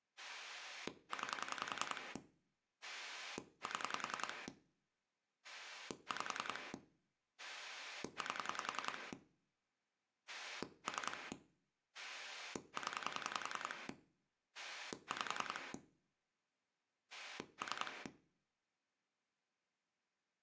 Pulse dialling, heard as a rotary dial, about 10 pulses a second, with room echo. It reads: 9 7 5 8 3 0 5 3